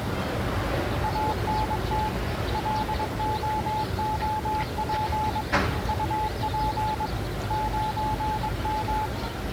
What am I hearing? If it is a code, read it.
Morse code, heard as a keyed tone, hand-sent with a paddle, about 22 wpm, 860 Hz, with the noise of a residential street. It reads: ANT LOOP UP 9M